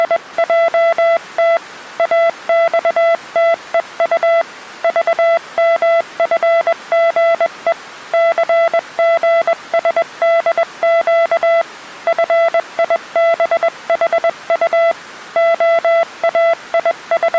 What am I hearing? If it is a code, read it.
Morse code, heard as a keyed tone, hand-sent with a paddle, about 21 wpm, 670 Hz. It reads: … AXTEU VMFGE CGSDQ FIBHU …